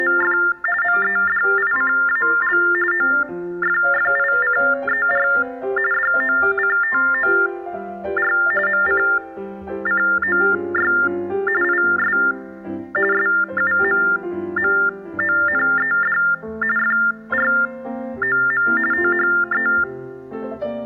TTY/TDD text telephone tones (45.45 baud Baudot), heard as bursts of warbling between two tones, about 400 Hz shift, 1600 Hz centre. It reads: … MEDICAL OFFICER DOCTOR MCCOY IS SUMMONED FROM THE